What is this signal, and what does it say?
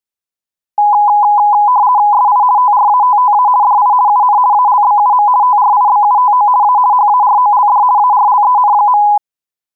RTTY (50 baud, 170 Hz shift), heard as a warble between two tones, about 910 Hz centre. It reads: SI TRATTA DI UN ALBUM TRIBUTO A HAROLD ARLEN.